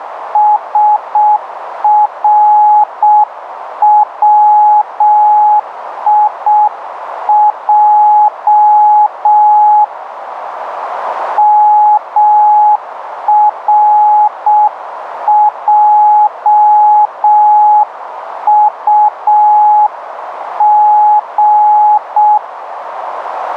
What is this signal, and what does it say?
Morse code (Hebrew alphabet), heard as a keyed tone, hand-sent with a paddle, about 6 wpm, 840 Hz, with radio static and a narrow filter. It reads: שרציע מרעטג